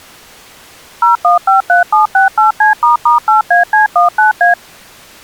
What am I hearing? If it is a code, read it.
DTMF, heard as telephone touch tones, dialled by machine, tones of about 130 ms. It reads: 0153768C**8AC19A